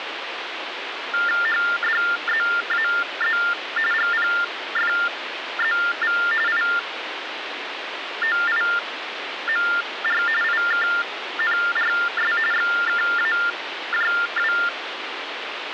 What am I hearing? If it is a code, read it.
TTY/TDD text telephone tones (45.45 baud Baudot), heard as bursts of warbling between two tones, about 400 Hz shift, 1600 Hz centre, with phone line noise. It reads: HDZAZ GPFZV IOIMR IKNRS XKAJW